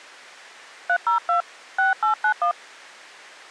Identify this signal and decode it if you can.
DTMF, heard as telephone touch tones, dialled by hand, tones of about 110 ms. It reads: 302 6891